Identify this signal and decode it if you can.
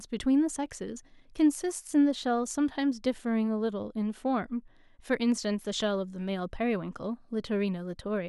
Speech in English. There is no code.